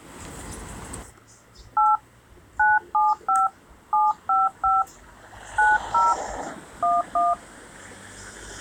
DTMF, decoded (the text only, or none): 8 975 755 90 11